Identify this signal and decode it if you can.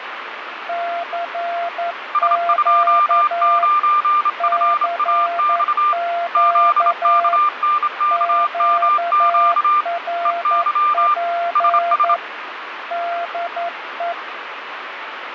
Morse code, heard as two keyed tones, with radio static. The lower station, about 11 wpm, 690 Hz: CQ CQ QRP DE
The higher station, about 27 wpm, 1190 Hz: S29FAX ZKNKMQ EY SS